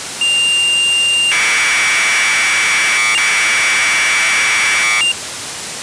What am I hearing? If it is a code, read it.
Commodore tape loading (standard loader), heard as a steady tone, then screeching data, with tape hiss.